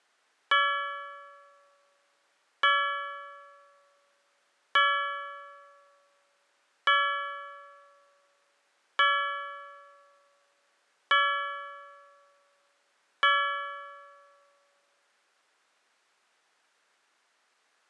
Clock strike, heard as a bell. 7. Seven o'clock.